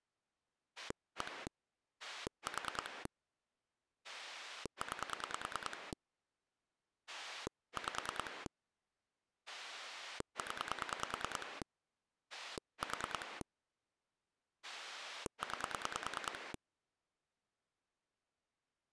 Pulse dialling, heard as a rotary dial, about 9 pulses a second. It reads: 1 4 9 5 0 4 9